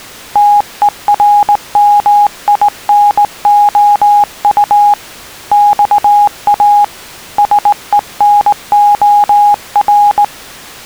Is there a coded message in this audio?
Yes: Morse code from 0.3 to 10.3 s, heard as a keyed tone, hand-sent with a straight key, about 19 wpm, 820 Hz. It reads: TERMINOU XA SENOR